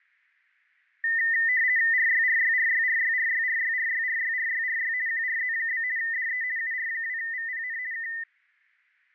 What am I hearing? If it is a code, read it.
RTTY (50 baud, 170 Hz shift), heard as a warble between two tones, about 1900 Hz centre, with fading. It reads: RYRYRYRYRYRYRYRYRYRY QRZ? DE UR2VPN K